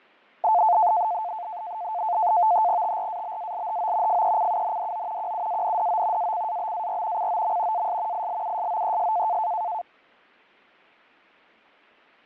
NAVTEX (SITOR-B), 100 baud, 170 Hz shift, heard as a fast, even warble, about 790 Hz centre, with fading. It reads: TRABALHO FECUNDO QUANDO ACABAR COM AS ILUSOES